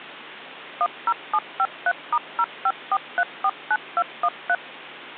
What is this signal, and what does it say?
DTMF, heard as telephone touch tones, dialled by machine, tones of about 50 ms. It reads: 10753*054349213